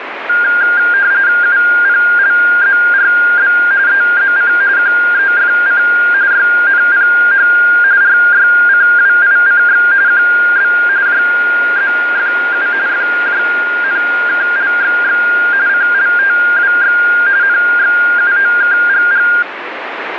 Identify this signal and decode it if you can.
RTTY (45.45 baud, 170 Hz shift), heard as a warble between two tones, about 1500 Hz centre, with radio static. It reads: UPLZRB EZC QEFC YNPH RYCWICX QB JZFU FJNKLXX CLTWX NXUOKGG